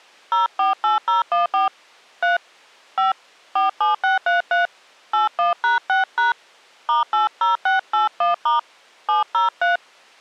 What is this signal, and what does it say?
DTMF, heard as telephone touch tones, dialled by hand, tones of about 140 ms. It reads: 048014 3 5 47633 81#6# *80681* 703